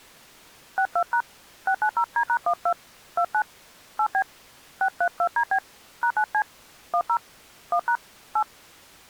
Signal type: DTMF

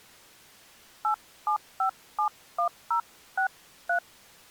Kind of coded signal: DTMF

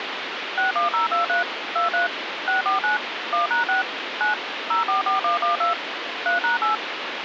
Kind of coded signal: DTMF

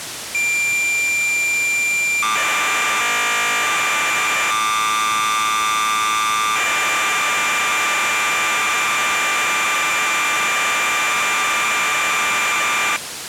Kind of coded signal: cassette data (Kansas City type)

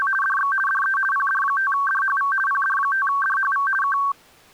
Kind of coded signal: RTTY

